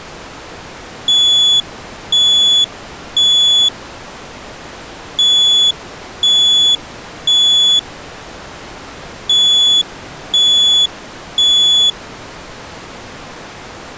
Alarm pattern, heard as an alarm's beeps, played three times, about 3400 Hz. Temporal three. Smoke or fire, evacuate.